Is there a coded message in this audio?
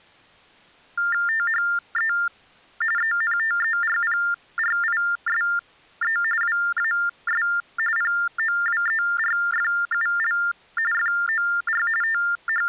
Yes: TTY/TDD text telephone tones (45.45 baud Baudot) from 1.0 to 12.7 s, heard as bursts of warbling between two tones, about 400 Hz shift, 1600 Hz centre. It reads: THE ENTERPRISE WAS POWERFUL FOR …